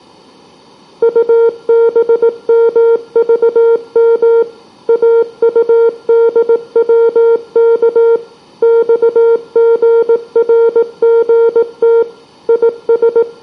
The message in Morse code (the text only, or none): UBMVM AUDWK XGRGT …